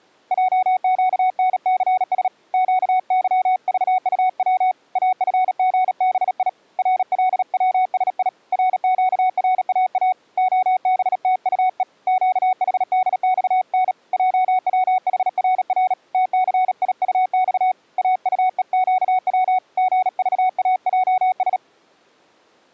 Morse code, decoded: JQNCS QYVUW AFGBI RLWSI RQRAA OBTUE QHDXN JWHRR TCIUX AUEQW GVAJS

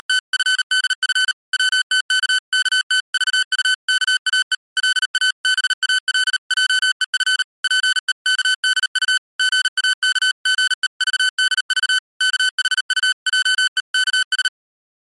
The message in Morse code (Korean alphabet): … 벙어리와 고독한 자의 송사를 위하여

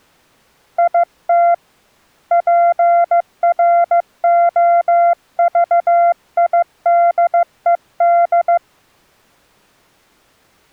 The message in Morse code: IT PROVIDED

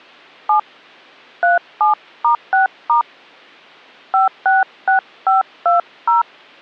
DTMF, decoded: 7 37*6* 566520

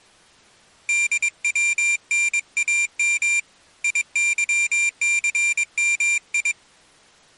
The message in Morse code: DWNAM IYCMI

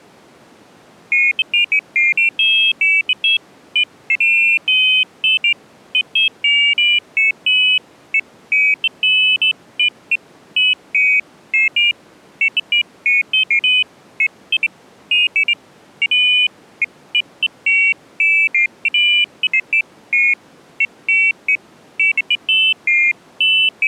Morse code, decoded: none

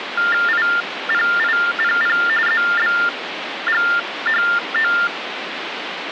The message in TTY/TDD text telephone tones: IPIPP ZBGHO

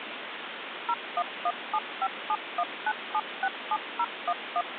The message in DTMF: 01175719767011

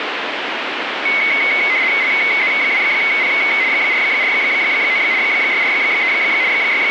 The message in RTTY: LZ2P 449 643 …

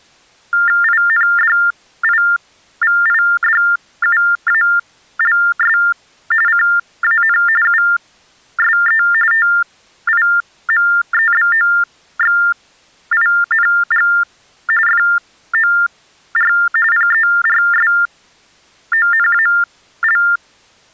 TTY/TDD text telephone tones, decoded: INDIVIDUALS CAN USE TIMEBOXING FOR PERSONAL

